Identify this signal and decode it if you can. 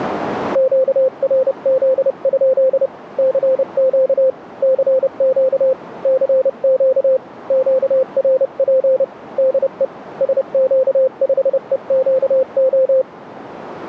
Morse code, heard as a keyed tone, hand-sent with a paddle, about 30 wpm, 520 Hz, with radio static. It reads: QRZ? CQ CQ CQ QRP DE SQ5EQO